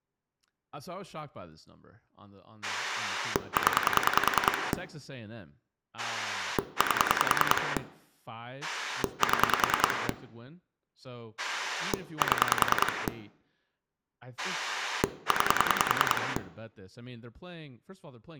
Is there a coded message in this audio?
Yes: pulse dialling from 2.6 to 16.4 s, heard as a rotary dial, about 10 pulses a second, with room echo and speech in English. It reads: 0 8 7 7 9